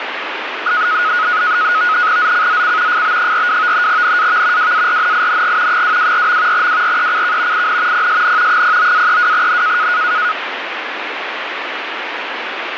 NAVTEX (SITOR-B), 100 baud, 170 Hz shift, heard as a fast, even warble, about 1360 Hz centre, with radio static. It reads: ZCZC FB42 NAV WARNING 224. WRECK IN PSN 09-32N